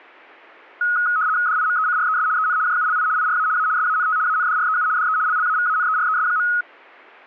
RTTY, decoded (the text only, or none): DIMECRES EN JULI IRA A SANT ANDREU DE LLAVANERES.